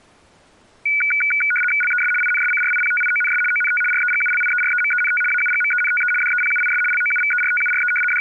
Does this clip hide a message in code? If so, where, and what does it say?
Yes: RTTY (75 baud, 850 Hz shift) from 0.9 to 8.2 s, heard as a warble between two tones, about 1900 Hz centre. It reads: LES INSCRIPTIONS ONT REGULIEREMENT AUGMENTE DEPUIS LOUVERTURE …